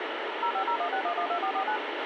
DTMF, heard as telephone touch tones, dialled by machine, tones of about 80 ms, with radio hiss and a squelch burst at the end. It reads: 05016112449